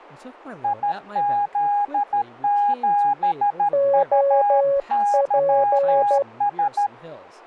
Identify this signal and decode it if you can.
Morse code, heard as two keyed tones, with speech in English. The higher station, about 13 wpm, 820 Hz: IZ7UYS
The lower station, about 12 wpm, 560 Hz: OP